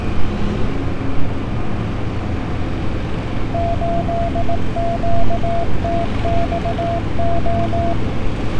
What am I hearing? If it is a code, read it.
Morse code, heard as a keyed tone, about 18 wpm, 680 Hz, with street noise. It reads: 8QTXO